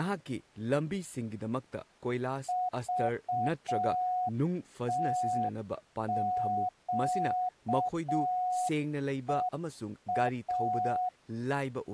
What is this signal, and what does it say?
Morse code, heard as a keyed tone, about 6 wpm, 730 Hz, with speech in Manipuri. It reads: VTQEA